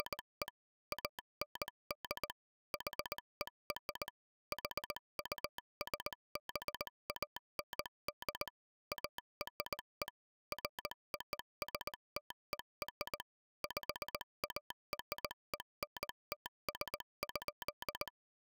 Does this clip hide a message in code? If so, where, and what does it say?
Yes: Morse code (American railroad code) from 0.0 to 18.1 s, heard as a telegraph sounder, machine-sent. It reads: … AND HER HUSBAND ARE FOSTER PARENTS.